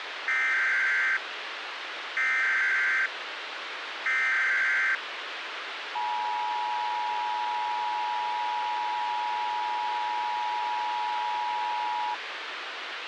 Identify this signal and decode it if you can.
Emergency Alert System (SAME) tones (header bursts, then the 853 and 960 Hz attention tone), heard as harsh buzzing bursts, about 520.83 baud, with radio hiss and a squelch burst at the end.